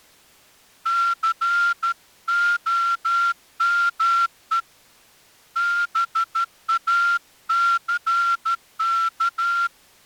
Morse code, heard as a whistle, hand-sent with a straight key, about 13 wpm. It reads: COME BACK